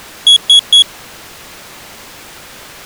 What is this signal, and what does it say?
Beep code, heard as a piezo beeper, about 3350 Hz. 3 short. In AMI BIOS tables: failure in the first 64 KB of memory; in Dell tables: chipset error.